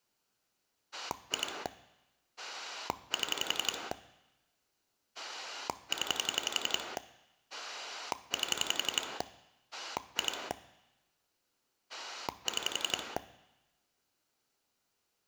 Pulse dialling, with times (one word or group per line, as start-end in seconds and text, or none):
0.9-1.7 2
2.4-3.9 7
5.1-7.0 0
7.5-9.2 8
9.7-10.5 2
11.9-13.2 6